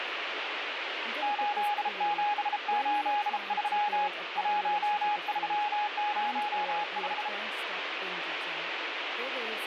Morse code, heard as a keyed tone, hand-sent with a bug key, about 33 wpm, 830 Hz, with heavy radio static and speech in English. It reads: 8783 1305